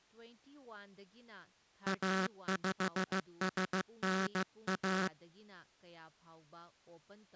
Morse code, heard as a buzzer, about 15 wpm, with speech in Manipuri. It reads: A5SNA